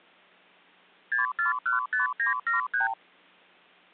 Multi-frequency trunk signalling (R2, with the far end's replies), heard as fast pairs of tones, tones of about 140 ms. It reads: 6415973